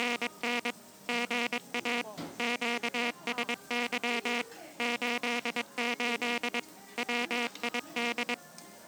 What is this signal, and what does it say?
Morse code, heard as a buzzer, machine-sent, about 22 wpm, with the noise of a restaurant. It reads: … GA QSY 88 WID